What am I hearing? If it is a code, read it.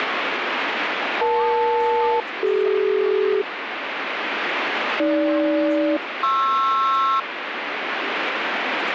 Aircraft SELCAL, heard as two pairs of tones, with radio static and speech in Nepali. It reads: EL-CD AG-PR